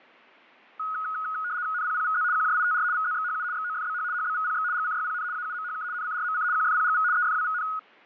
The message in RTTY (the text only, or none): NPPVZ QJITR VZXHU XOFBH HBVPX GCYPN AUMHK NCRMC QFPGV EFWVN